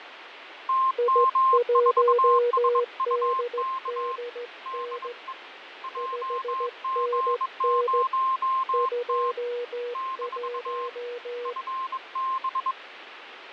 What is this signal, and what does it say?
Morse code, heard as two keyed tones, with radio static and fading. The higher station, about 22 wpm, 1060 Hz: TM4SUK DE JG0T - FB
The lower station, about 15 wpm, 480 Hz: I1DDN 5NN 21